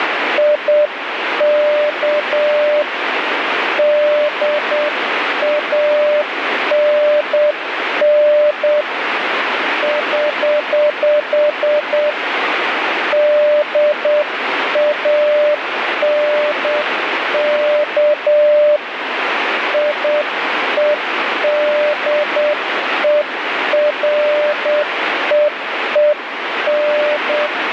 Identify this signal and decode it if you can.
Morse code, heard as a keyed tone, hand-sent with a paddle, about 8 wpm, 600 Hz, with radio static. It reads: IK DANN <HH> DANK IEDEREEN